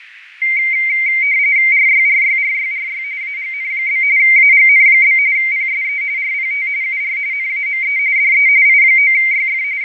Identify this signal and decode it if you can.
RTTY (45.45 baud, 170 Hz shift), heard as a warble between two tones, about 2200 Hz centre, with radio static, fading and a narrow filter. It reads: RYRYRYRY AGN? AGN? PSE RPT UR NAME DE I9YF …